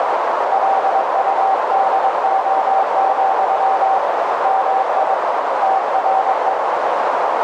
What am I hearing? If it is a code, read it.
Morse code, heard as a keyed tone, hand-sent with a paddle, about 22 wpm, 770 Hz, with heavy radio static and a narrow filter. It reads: LUDO, MI TRE